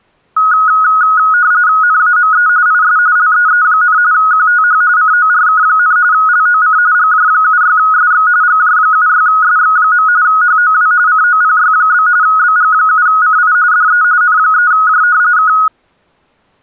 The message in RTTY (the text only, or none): NAME IS LEE, QTH CORK, LOC GJ76SX GJ76SX. HOW COPY? BG7CI DE N3J K